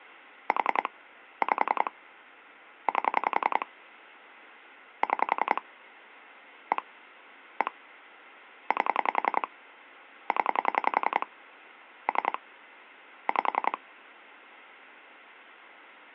Pulse dialling, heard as clicks on a phone line, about 10 pulses a second. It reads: 4 5 8 6 1 1 8 0 3 5